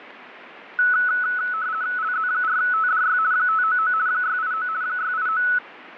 RTTY (50 baud, 170 Hz shift), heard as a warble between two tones, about 1390 Hz centre, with radio static and fading. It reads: LZ4TDY 599 689 689